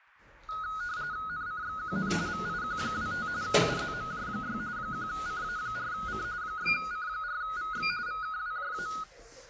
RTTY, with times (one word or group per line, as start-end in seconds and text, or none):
1.3-2.1 NCXQN
2.3-3.3 VIQ25
3.4-4.6 UZMJ6
4.8-6.2 1CA4C
6.4-7.9 6C4VX
8.1-8.9 VKWJA